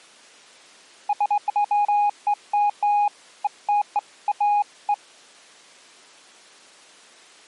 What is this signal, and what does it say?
Beeps of irregular length. There is no code.